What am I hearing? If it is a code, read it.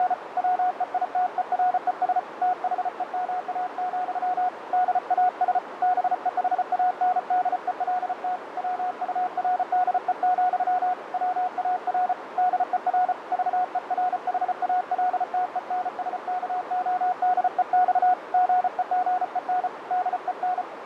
Morse code, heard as a keyed tone, hand-sent with a paddle, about 34 wpm, 730 Hz, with radio static, fading and a narrow filter. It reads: … WEITERES THEMA, DAS BEHANDELT WURDE, WAR DER VERHALTENSKODEX GEGEN DEN